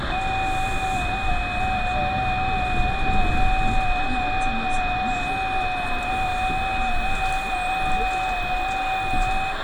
FT8 (several signals at once), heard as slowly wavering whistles, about 6.25 baud, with radio static, room echo and the noise inside a bus.